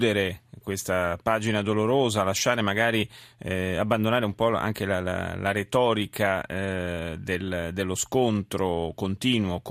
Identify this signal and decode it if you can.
Speech in Italian. There is no code.